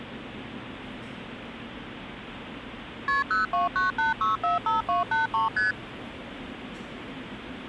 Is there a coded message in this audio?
Yes: multi-frequency trunk signalling (R1, as on North American trunks) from 3.1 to 5.7 s, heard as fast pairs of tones, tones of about 150 ms, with the noise of a subway station. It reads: KP 0298645283 ST